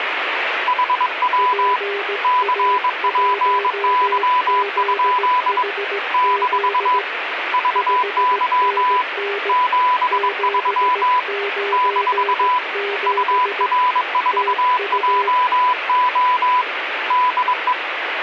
Morse code, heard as two keyed tones, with radio static. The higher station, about 22 wpm, 1000 Hz: HW CPY? - VY 73 - UR4JO DE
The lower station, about 17 wpm, 400 Hz: PA1ZHZ 5NN 797 TU